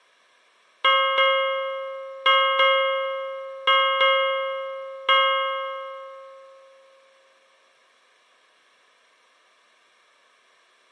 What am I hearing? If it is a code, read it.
Ship's bell, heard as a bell, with room echo. 7. Seven half-hours of the watch have passed.